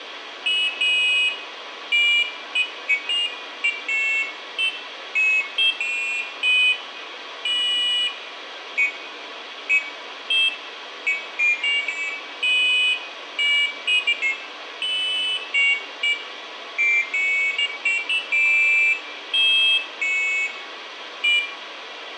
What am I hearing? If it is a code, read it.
Pairs of high tones at irregular times, with radio hiss and room echo. There is no code.